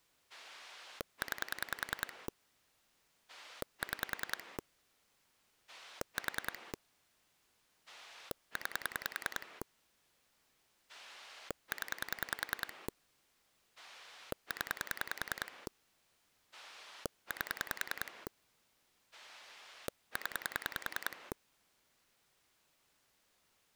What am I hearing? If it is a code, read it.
Pulse dialling, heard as a rotary dial, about 10 pulses a second. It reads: 9 6 4 9 0 0 8 0